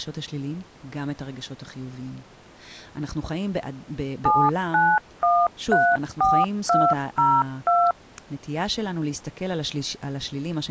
DTMF, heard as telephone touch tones, dialled by machine, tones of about 240 ms, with speech in Hebrew. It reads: 79134202